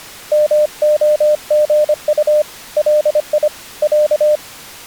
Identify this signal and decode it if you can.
Morse code (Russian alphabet), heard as a keyed tone, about 25 wpm, 600 Hz. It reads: МОГУ ЛИ Я